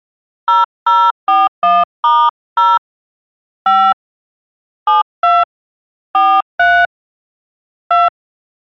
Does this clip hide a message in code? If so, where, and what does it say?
Yes: DTMF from 0.5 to 8.1 s, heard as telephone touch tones, dialled by hand, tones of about 210 ms. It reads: 0041*0 5 72 43 2